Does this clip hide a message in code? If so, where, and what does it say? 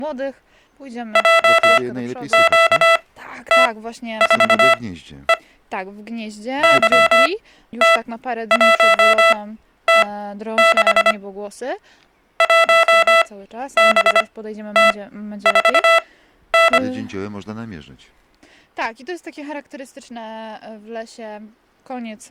Yes: Morse code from 1.1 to 16.8 s, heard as electronic beeps, machine-sent, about 25 wpm, spaced as for 12 wpm, 660 Hz. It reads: JQT4E YT1T6 1BT4N